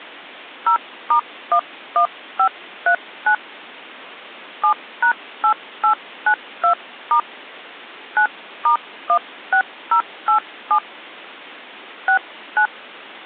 DTMF, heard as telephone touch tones, dialled by hand, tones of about 90 ms. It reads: 0*11539 7#8892* 9*16087 69